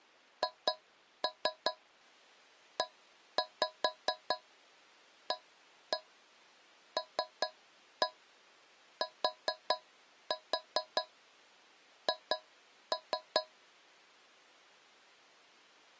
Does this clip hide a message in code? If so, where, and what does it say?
Yes: tap code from 0.4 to 13.5 s, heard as taps on a metal pipe, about 4 knocks a second. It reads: HEALTH